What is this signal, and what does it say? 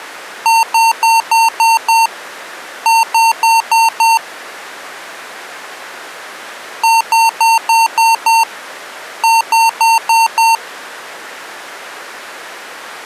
Beep code, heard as beeps from a small speaker, played twice, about 910 Hz. 6-5.